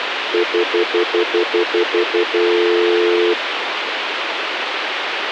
Telephone call progress tone (North American plan), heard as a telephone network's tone, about 350, 440 Hz, 0.1 s on and 0.1 s off, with phone line noise. Stutter dial tone.